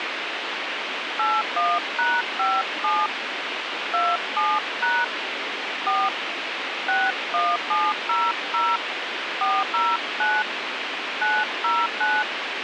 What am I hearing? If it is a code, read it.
DTMF, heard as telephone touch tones, dialled by hand, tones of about 220 ms, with radio hiss. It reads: 81#57 27# 4 61700 409 909